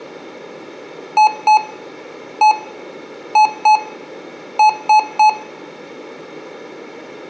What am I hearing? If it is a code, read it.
Beep code, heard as beeps from a small speaker, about 860 Hz, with room echo. 2-1-2-3. In Phoenix BIOS tables: ROM copyright notice check failure.